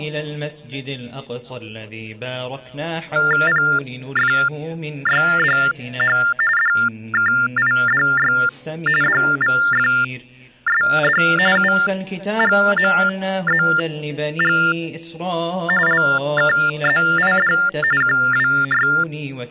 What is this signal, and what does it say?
TTY/TDD text telephone tones (45.45 baud Baudot), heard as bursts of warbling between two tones, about 400 Hz shift, 1600 Hz centre. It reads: PFYDH DKIDY DVFSD UGMZG LKZID …